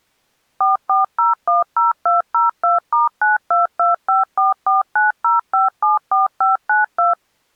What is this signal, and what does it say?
DTMF, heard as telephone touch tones, dialled by machine, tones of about 150 ms. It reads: 44010202*92254490574592